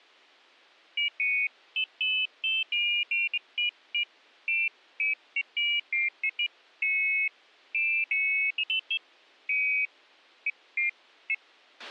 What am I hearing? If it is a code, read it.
Pairs of high tones at irregular times, with a squelch burst at the end. There is no code.